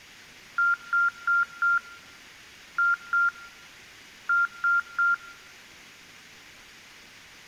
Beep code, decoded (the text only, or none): 4-2-3